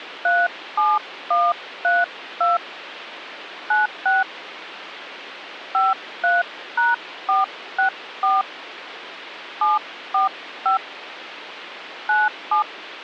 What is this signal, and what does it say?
DTMF, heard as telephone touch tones, dialled by hand, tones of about 160 ms, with phone line noise. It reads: 37132 96 53#464 745 97